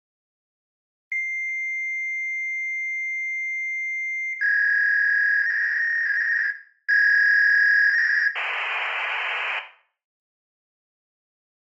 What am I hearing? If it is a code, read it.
Fax machine handshake, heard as a long tone, a warble and hiss, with room echo.